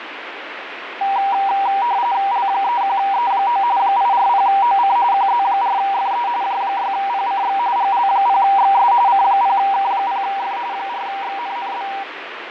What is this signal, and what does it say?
RTTY (45.45 baud, 170 Hz shift), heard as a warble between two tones, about 870 Hz centre, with radio static and fading. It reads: L31E9 840OC QZ4FE J6PCX GL0XS C0K0F 4XNNB